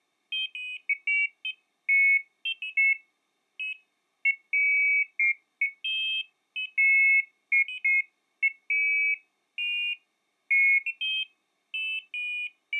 Pairs of high tones at irregular times. There is no code.